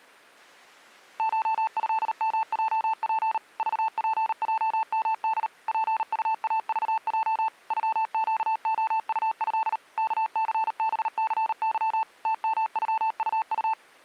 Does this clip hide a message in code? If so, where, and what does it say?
Yes: Morse code (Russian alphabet) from 1.1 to 13.8 s, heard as a keyed tone, machine-sent, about 38 wpm, 880 Hz. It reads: ШЭМЙП ЖПЙМД ПУАЖЙ ЮЩОУЭ КЦБЦЫ ТМЮУУ